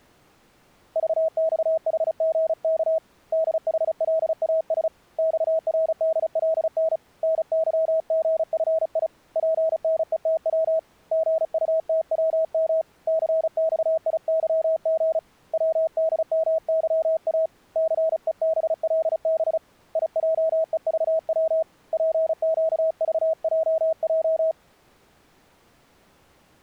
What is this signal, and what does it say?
Morse code, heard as a keyed tone, hand-sent with a paddle, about 35 wpm, 640 Hz. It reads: VXHGK DHLAS XRDLN NYGFI PNETW GUTWM CXIYG WDMYA CEBLB IJEVW PQVJJ